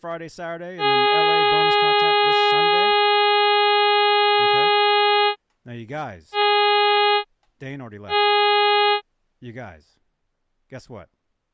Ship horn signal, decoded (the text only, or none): 1 long, 2 short